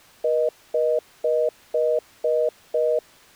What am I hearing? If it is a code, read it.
Telephone call progress tone (North American plan), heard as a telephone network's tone, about 480, 620 Hz, 0.25 s on and 0.25 s off. Congestion tone.